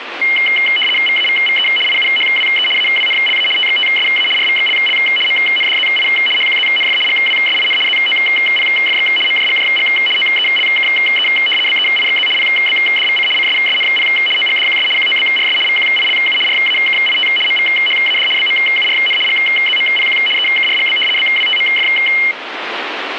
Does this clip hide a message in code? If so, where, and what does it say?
Yes: RTTY (75 baud, 850 Hz shift) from 0.2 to 22.3 s, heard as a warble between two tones, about 2550 Hz centre, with radio static. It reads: VAVVE IUHWE AWNLA TXTSA RVXLL MNDZI HQZNF GWSIN ZOPFX MJGJG OELKE BEIXZ PBDVC CSSNP OGDQS QOBRS VQILU RAKIT MVHAD BMURN GZMPQ EKRGB BWTMF